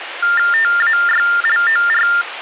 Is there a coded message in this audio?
Yes: TTY/TDD text telephone tones (45.45 baud Baudot) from 0.2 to 2.2 s, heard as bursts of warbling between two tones, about 400 Hz shift, 1600 Hz centre, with phone line noise. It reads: TAYLOR